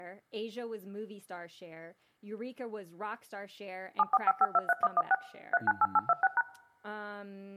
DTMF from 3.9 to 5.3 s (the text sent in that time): 745523116